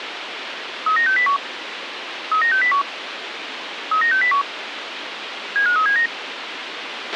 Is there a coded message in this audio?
Yes: five-tone selective call (CCIR) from 0.9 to 6.1 s, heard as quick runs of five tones, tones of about 100 ms, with radio hiss and a squelch burst at the end. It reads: 39601 39601 39601 75379